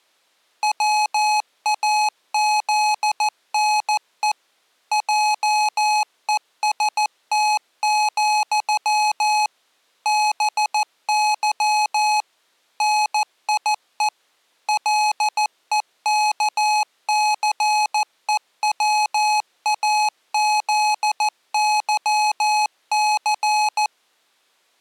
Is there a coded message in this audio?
Yes: Morse code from 0.6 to 23.9 s, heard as electronic beeps, machine-sent, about 14 wpm, 850 Hz. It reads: WAZNE JEST, BY NIE LEKCEWAZYC